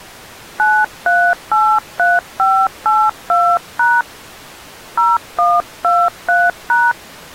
DTMF, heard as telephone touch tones, dialled by hand, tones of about 230 ms. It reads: 9383582# 0123#